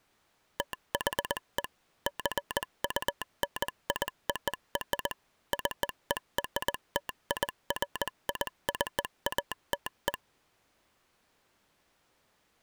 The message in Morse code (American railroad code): THE JUNIOR CERTIFICATE

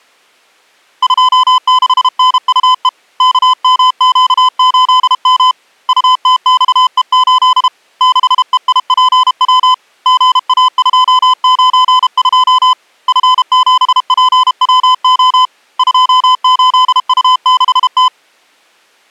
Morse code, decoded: 26NUE KMQ8M UTXE8 6EIPW GA292 F7PWO 28U6T

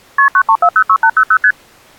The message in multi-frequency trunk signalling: KP 93406800 ST

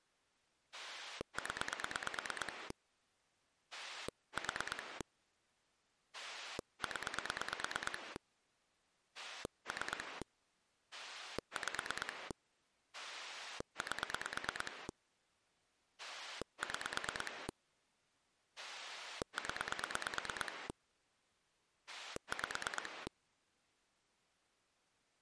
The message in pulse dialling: 0 4 0 3 5 8 6 0 5

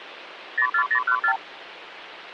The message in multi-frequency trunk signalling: 04014

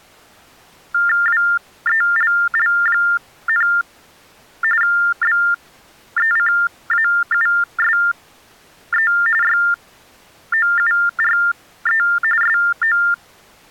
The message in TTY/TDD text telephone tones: WELL, BECAUSE YOURE SO

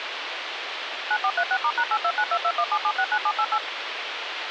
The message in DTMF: 9436*#8292217769788

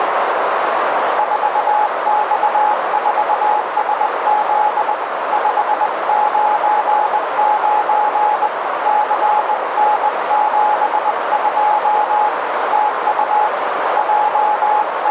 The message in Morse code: 4X4SZ 599 CN72 TU …

